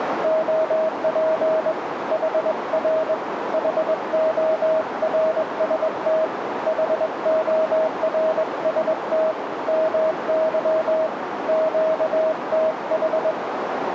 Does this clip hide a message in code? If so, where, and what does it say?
Yes: Morse code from 0.2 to 13.4 s, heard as a keyed tone, hand-sent with a straight key, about 21 wpm, 640 Hz, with radio static and a narrow filter. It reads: OP HR HORST HORST MY QTH